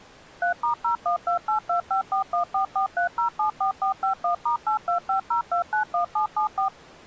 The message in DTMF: 3*01282541443074451*8250291774

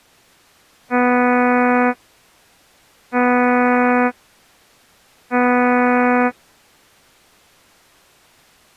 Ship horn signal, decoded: 3 short

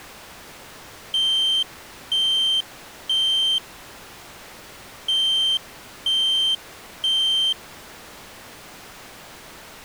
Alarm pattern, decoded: temporal three

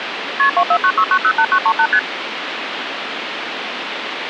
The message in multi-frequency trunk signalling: KP 2496908938 ST

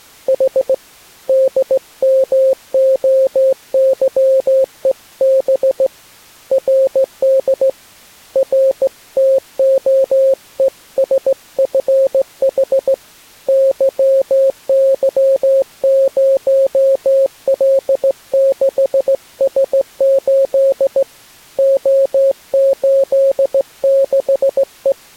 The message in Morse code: H DMOYEB RD RTOESFH YY0L6S8 O86E

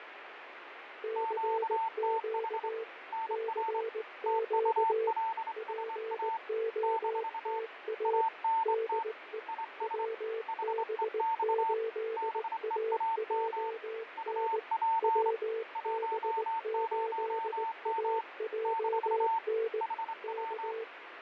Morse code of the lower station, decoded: CQ CQ POTA DE WB8AJN WB8AJN K

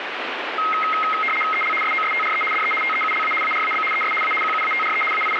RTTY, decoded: EL SOSTRE DE TEULA ARAB ES A QUATRE …

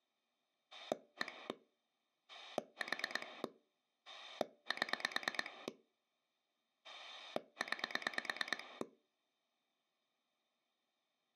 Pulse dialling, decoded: 1 4 7 9

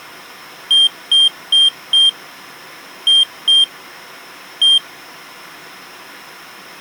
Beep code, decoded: 4-2-1

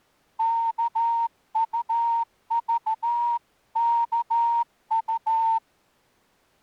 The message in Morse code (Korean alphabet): 일이

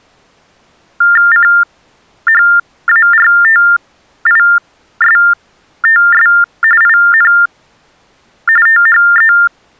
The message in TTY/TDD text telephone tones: CHARTISTS IN THE

